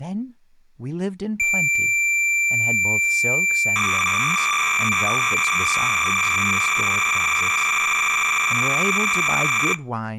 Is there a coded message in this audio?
Yes: cassette data (Kansas City type), 300 baud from 1.4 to 9.7 s, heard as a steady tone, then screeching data, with speech in English.